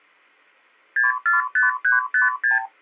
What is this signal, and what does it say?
Multi-frequency trunk signalling (R2, with the far end's replies), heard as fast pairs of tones, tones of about 150 ms. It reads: 645356